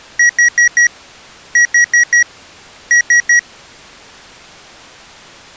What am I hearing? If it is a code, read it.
Beep code, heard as beeps from a small speaker, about 1900 Hz. 4-4-3. In Phoenix BIOS tables: maths coprocessor failure.